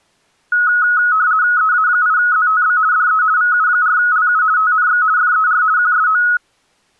RTTY (50 baud, 170 Hz shift), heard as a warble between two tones, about 1370 Hz centre. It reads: EA8ZTB DE VU4LU TNX FER QSO